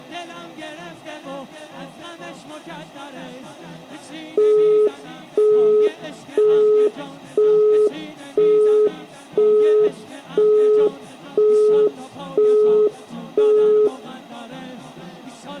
Telephone call progress tone (single-tone plan, as in Europe, Japan and elsewhere), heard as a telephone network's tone, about 420 Hz, 0.5 s on and 0.5 s off, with room echo. Busy tone.